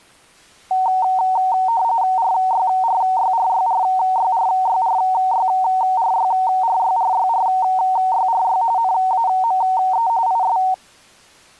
RTTY (45.45 baud, 170 Hz shift), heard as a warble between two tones, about 840 Hz centre. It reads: RYRYRYRYRYRYRYRYRYRYRY NAME IS